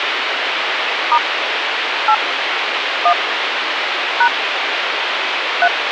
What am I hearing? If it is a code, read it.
DTMF, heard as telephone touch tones, dialled by hand, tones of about 70 ms, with phone line noise. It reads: * 8 1 # 3